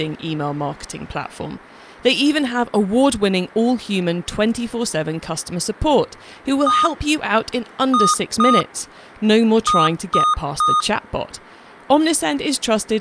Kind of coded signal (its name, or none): beep code